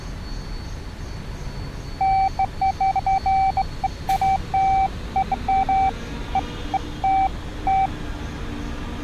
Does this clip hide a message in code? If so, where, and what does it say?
No, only beeps of irregular length, with street noise.